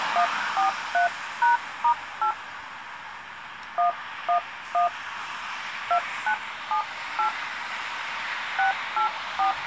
DTMF, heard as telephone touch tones, dialled by hand, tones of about 110 ms, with street noise. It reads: 143#*8 111 2978 684